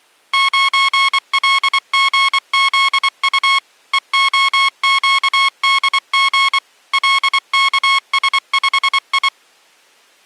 Morse code, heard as electronic beeps, machine-sent, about 24 wpm, 1090 Hz. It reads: 9LGZU EOQDG LKS5I